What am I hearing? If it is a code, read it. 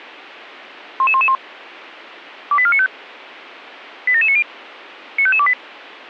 Five-tone selective call (ZVEI), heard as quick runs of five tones, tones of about 70 ms, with a squelch burst at the end. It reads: 11111 28495 87790 95528